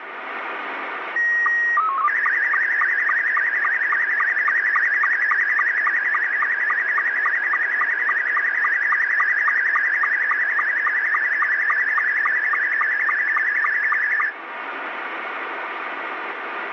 SSTV (slow-scan television), Scottie S2, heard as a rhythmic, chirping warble, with radio static.